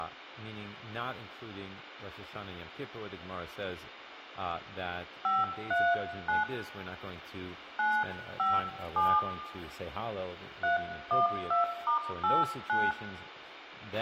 DTMF, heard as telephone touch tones, dialled by hand, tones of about 180 ms, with a squelch burst at the end, room echo and speech in English. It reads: 539 957 312*89